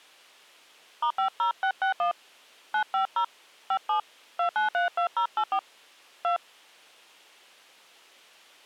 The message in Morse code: none

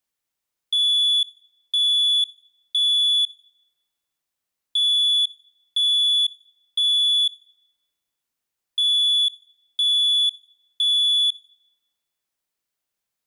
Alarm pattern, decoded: temporal three

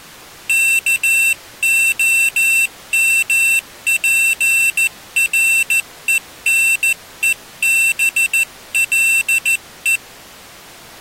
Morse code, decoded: KOMPRENEBLE

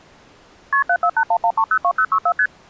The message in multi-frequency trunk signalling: KP 74811302064 ST

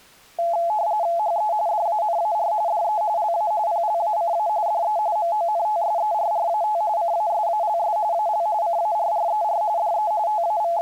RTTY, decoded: HE DANAR DE LA PLACA DE MONTSERRAT CASALS AL CARRER DE …

